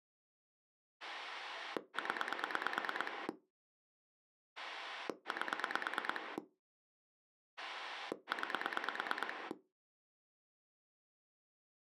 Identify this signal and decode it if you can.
Pulse dialling, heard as a rotary dial, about 9 pulses a second. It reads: 0 8 9